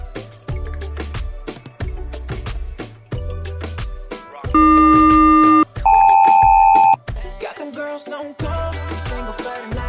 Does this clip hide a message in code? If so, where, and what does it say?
Yes: aircraft SELCAL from 4.5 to 6.9 s, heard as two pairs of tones. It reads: AQ-KL